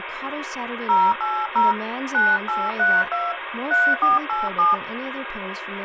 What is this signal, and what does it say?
DTMF, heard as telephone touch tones, dialled by hand, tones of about 210 ms, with phone line noise and speech in English. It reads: 080 9832 3487